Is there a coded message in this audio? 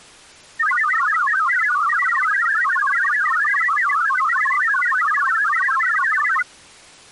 Yes: multi-tone FSK (Olivia or MFSK type), about 1000 Hz wide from 0.6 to 6.4 s, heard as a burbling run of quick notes, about 62.5 baud.